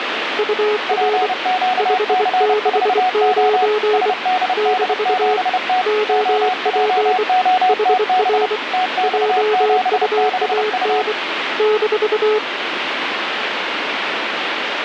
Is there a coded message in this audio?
Yes: Morse code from 0.3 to 12.4 s, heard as two keyed tones, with radio static. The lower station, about 24 wpm, 420 Hz: UR 569 - OP HR JUAN -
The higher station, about 30 wpm, 740 Hz: PQC4O SDD7T OJOTB TX76U